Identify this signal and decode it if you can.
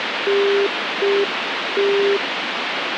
Telephone call progress tone (UK plan), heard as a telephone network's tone, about 400 Hz, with phone line noise. Congestion tone.